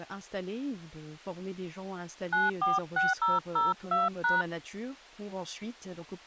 DTMF, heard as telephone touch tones, dialled by hand, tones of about 180 ms, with speech in French. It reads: 946002#